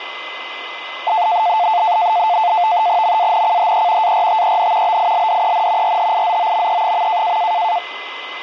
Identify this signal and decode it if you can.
NAVTEX (SITOR-B), 100 baud, 170 Hz shift, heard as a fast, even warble, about 790 Hz centre, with radio static and a steady whistle near 2040 Hz. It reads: MANCHE ARTEN BILDEN RHIZOME.